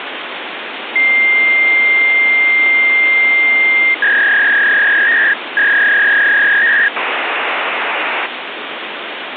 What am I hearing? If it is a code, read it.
Fax machine handshake, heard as a long tone, a warble and hiss, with phone line noise.